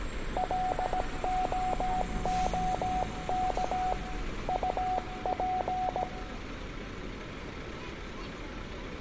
Morse code, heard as a keyed tone, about 17 wpm, 740 Hz, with room echo and street noise. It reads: LOOK UP